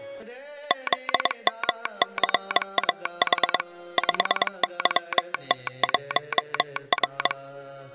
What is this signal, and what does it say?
Morse code, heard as a telegraph sounder, machine-sent, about 22 wpm. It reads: ZMCAH 5YT1R